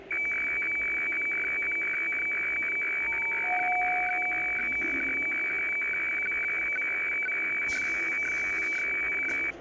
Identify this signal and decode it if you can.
Weather fax (radiofax), 120 lines a minute, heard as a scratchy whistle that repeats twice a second, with the noise inside a lift.